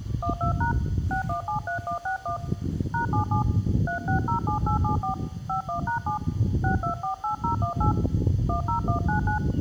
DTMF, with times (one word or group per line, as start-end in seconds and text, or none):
0.2-0.7 12#
1.1-2.4 6173161
2.9-3.4 #77
3.9-5.1 3607874
5.5-6.2 51#7
6.6-7.9 6248018
8.5-9.4 10199